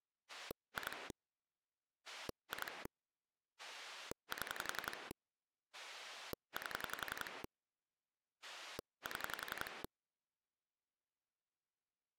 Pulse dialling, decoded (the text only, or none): 2 2 7 8 7